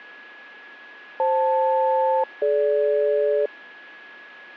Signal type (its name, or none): aircraft SELCAL